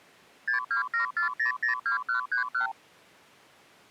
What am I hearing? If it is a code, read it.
Multi-frequency trunk signalling (R2, with the far end's replies), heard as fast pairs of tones, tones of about 120 ms. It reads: 6274002131